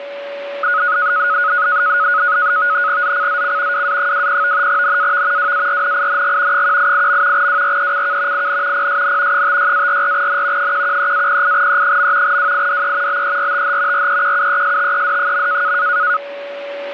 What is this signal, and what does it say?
NAVTEX (SITOR-B), 100 baud, 170 Hz shift, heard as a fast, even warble, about 1360 Hz centre, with a steady whistle near 570 Hz. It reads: ZCZC WA20 NAV WARNING 188. WRECK IN PSN 56-44N 113-08E. WIDE BERTH REQUESTED.